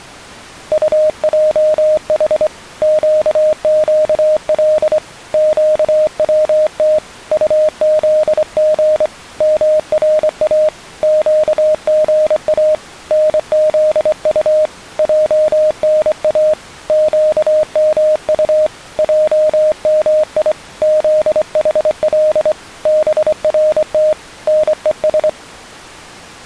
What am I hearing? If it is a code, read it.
Morse code (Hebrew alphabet), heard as a keyed tone, hand-sent with a straight key, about 24 wpm, 620 Hz. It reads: טעח קקל קצת טזג מרא קגא נזט ענא קמט עמי זחל ברת נוש